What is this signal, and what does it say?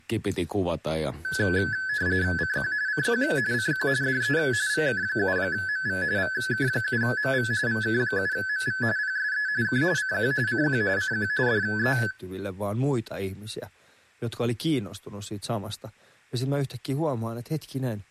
RTTY (45.45 baud, 170 Hz shift), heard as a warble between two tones, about 1600 Hz centre, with speech in Finnish. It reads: CQ CQ CQ DE VK7MV VK7MV VK7MV PSE K CQ CQ CQ DE